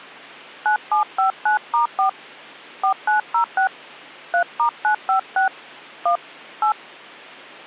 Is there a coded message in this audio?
Yes: DTMF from 0.7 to 6.7 s, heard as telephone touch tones, dialled by hand, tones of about 110 ms. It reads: 9759*4 4906 3*956 1 8